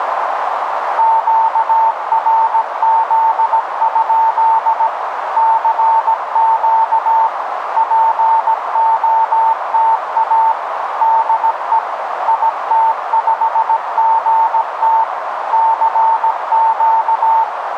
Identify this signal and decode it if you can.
Morse code, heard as a keyed tone, machine-sent, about 17 wpm, 900 Hz, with radio static and a narrow filter. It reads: QRZ? CQ POTA DE IT5GT CQ